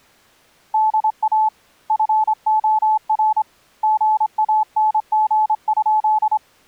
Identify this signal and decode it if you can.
Morse code, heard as a keyed tone, hand-sent with a straight key, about 25 wpm, 860 Hz. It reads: DA FOR GANG?